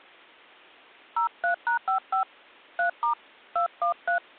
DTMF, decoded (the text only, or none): 03#55 3* 213